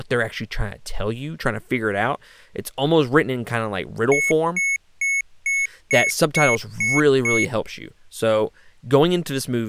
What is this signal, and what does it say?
Beep code, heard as beeps from a small speaker, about 2200 Hz, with speech in English. 8 short. In AMI BIOS tables: display memory failure; in Dell tables: LCD failure.